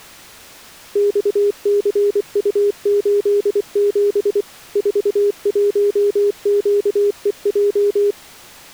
Morse code, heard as a keyed tone, machine-sent, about 24 wpm, 410 Hz. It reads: XCU87 41QEJ